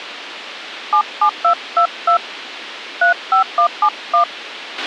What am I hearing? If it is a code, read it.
DTMF, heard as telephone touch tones, dialled by hand, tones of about 90 ms, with a squelch burst at the end. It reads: 77222 35171